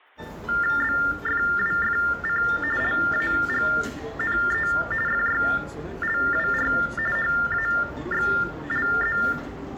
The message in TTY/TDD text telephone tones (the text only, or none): BFWFC LAGNE FYLWR HAXLZ